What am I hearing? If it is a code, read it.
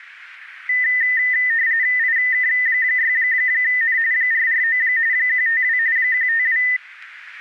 RTTY (45.45 baud, 170 Hz shift), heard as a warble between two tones, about 1900 Hz centre. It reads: IK6N 449 152 152